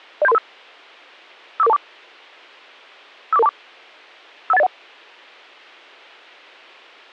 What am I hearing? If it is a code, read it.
Five-tone selective call (EIA), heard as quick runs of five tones, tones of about 30 ms. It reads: 07335 54424 54424 51801